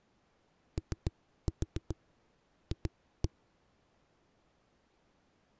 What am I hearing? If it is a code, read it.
Tap code, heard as knocks on a wall, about 7 knocks a second. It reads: OF